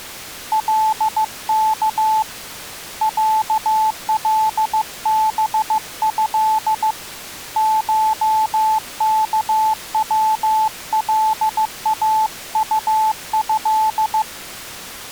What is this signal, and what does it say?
Morse code (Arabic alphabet), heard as a keyed tone, hand-sent with a paddle, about 15 wpm, 870 Hz. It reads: لك علبه شكولاطه